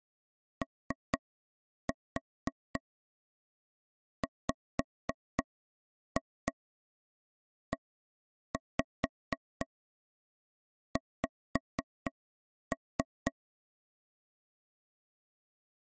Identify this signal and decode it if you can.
Tap code, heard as taps on a table, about 4 knocks a second. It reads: OWEX